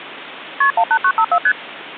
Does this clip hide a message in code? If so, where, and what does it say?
Yes: multi-frequency trunk signalling (R1, as on North American trunks) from 0.6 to 1.5 s, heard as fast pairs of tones, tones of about 70 ms. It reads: KP 18954 ST